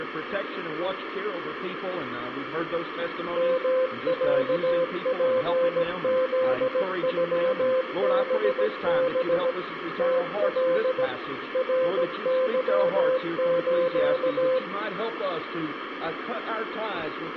Morse code (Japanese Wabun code), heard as a keyed tone, machine-sent, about 17 wpm, 520 Hz, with radio static and room echo. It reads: ヨロツフノハハ ムカ ナケス